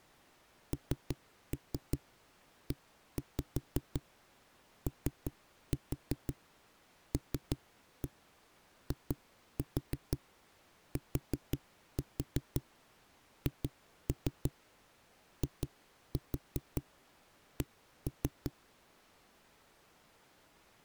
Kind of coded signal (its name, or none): tap code